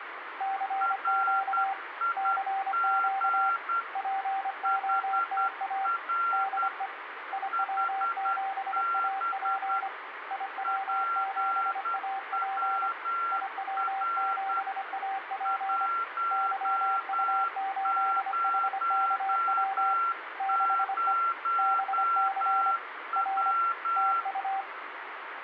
Morse code, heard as two keyed tones, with radio static. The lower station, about 25 wpm, 780 Hz: CQ CQ POTA DE IW7AP IW7AP IW7AP YU8HKW 6E BC R TU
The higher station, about 10 wpm, 1370 Hz: RIG HR HB PWR 100W